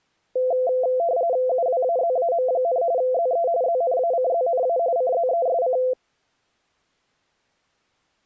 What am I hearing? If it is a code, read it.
RTTY (45.45 baud, 170 Hz shift), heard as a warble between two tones, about 600 Hz centre. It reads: UWAZAM, ZE ZNACZNA CZESC